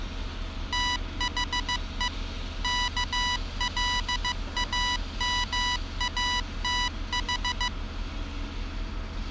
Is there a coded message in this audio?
Yes: Morse code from 0.7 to 7.7 s, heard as electronic beeps, machine-sent, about 15 wpm, 980 Hz, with street noise. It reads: THE KLAMATH